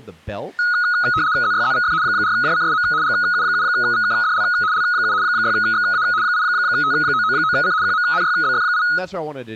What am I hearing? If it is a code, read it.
RTTY (75 baud, 170 Hz shift), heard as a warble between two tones, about 1360 Hz centre, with speech in English. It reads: ZYZVF 4JCSM GU7VKDL L7 6XA 8T999C QMNYBF8